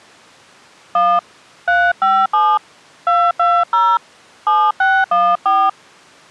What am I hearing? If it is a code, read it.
DTMF, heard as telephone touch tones, dialled by hand, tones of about 240 ms. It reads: 1 357 220 7614